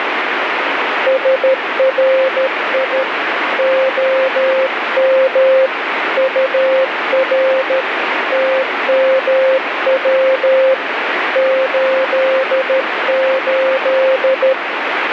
Morse code, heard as a keyed tone, hand-sent with a paddle, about 13 wpm, 530 Hz, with radio static. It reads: SRI OM UR TMW 88